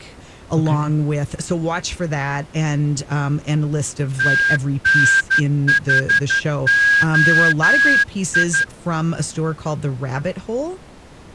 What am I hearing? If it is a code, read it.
Morse code, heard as a whistle, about 12 wpm, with speech in English. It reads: TNHOI